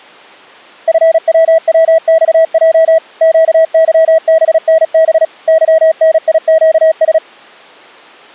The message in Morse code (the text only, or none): FWWXJ QYBNB YNIQS